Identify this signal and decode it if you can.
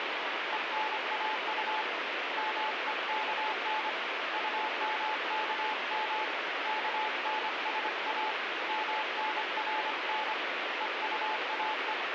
Morse code, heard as a keyed tone, hand-sent with a paddle, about 25 wpm, 860 Hz, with heavy radio static. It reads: ENAU MEKN UMKM KNSA MNRN EUAE